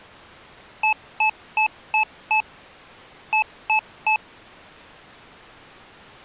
Beep code, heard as beeps from a small speaker, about 870 Hz. 5-3.